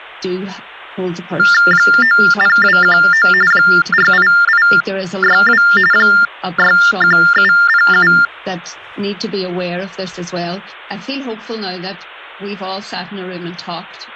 TTY/TDD text telephone tones (45.45 baud Baudot), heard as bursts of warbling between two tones, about 400 Hz shift, 1600 Hz centre. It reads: 90219 48862 61707